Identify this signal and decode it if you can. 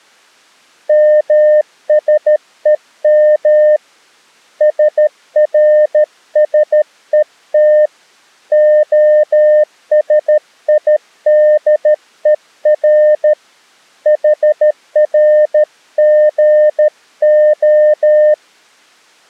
Morse code (Hebrew alphabet), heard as a keyed tone, hand-sent with a paddle, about 13 wpm, 610 Hz. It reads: משום שרשות השידור חרגה